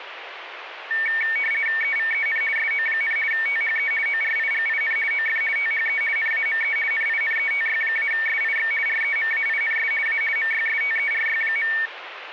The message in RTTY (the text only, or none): EVEN SO, THE ORIGIN OF THE NAME NINETY-SIX REMAINS A MYSTERY.